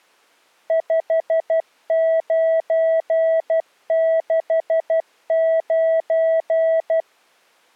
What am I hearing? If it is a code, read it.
Morse code, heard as a keyed tone, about 12 wpm, 650 Hz. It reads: 5969